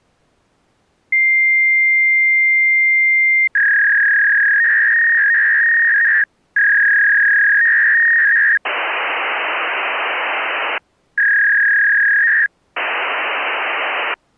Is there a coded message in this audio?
Yes: fax machine handshake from 1.1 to 14.1 s, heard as a long tone, a warble and hiss.